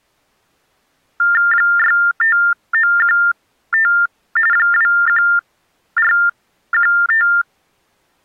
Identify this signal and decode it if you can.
TTY/TDD text telephone tones (45.45 baud Baudot), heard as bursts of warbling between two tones, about 400 Hz shift, 1600 Hz centre. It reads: 65915 21415